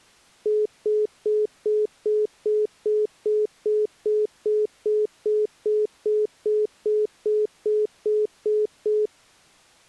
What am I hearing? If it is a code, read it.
Telephone call progress tone (single-tone plan, as in most of Europe), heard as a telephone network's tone, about 420 Hz, 0.2 s on and 0.2 s off. Congestion tone.